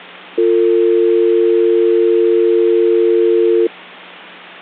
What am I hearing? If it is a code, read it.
Telephone call progress tone (North American or UK plan), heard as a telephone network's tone, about 350, 450 Hz. Dial tone.